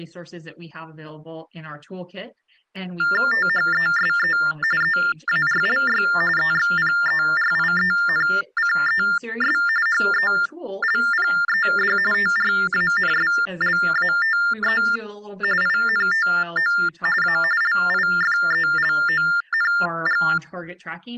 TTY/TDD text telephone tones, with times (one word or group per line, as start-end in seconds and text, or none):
3.3-4.4 THESE
4.8-6.0 EARLY
6.4-9.6 EXPERIENCES
9.9-12.0 HELPED
12.1-14.8 TRANSLATE
15.6-16.7 INTO
17.2-17.4 A
17.6-20.2 LIFELONG